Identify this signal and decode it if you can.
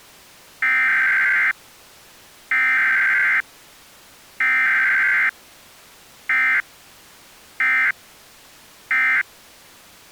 Emergency Alert System (SAME) tones (header bursts, then end-of-message bursts), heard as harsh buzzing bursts, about 520.83 baud.